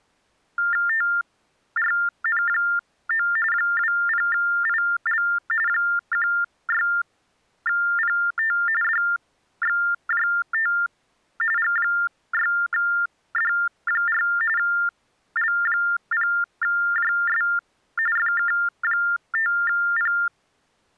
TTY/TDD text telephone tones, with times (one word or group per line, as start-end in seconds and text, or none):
0.9-3.3 TRN9
3.5-5.2 20IL
5.7-8.6 16PT
8.8-10.7 DXJT
11.6-14.2 G6D4
14.6-17.4 L0JS
18.2-20.1 FK5P